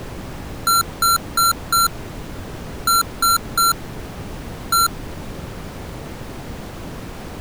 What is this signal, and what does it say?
Beep code, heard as beeps from a small speaker, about 1360 Hz. 4-3-1. In Phoenix BIOS tables: memory failure above the first 64 KB.